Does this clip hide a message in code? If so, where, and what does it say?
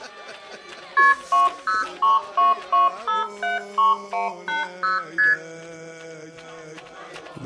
Yes: multi-frequency trunk signalling (R1, as on North American trunks) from 1.0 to 5.3 s, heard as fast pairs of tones, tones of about 160 ms. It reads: KP 20322573180 ST